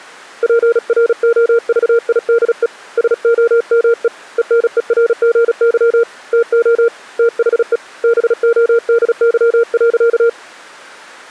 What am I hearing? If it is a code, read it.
Morse code, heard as a keyed tone, hand-sent with a paddle, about 36 wpm, 470 Hz. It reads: PROVIDE SOME ENERGY TO THE BODY.